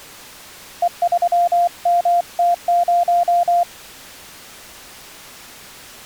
Morse code, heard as a keyed tone, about 24 wpm, 700 Hz. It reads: E3MT0